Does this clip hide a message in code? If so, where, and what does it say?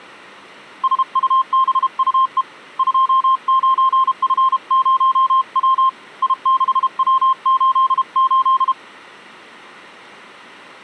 Yes: Morse code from 0.8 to 8.8 s, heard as a keyed tone, hand-sent with a paddle, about 32 wpm, 1060 Hz. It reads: SUBUE 29F0W I6W88